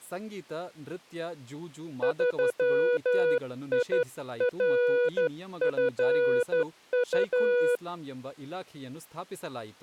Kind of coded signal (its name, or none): Morse code